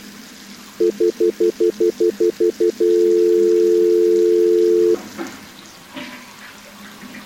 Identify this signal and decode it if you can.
Telephone call progress tone (North American plan), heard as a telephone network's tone, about 350, 440 Hz, 0.1 s on and 0.1 s off, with the noise of a restroom. Stutter dial tone.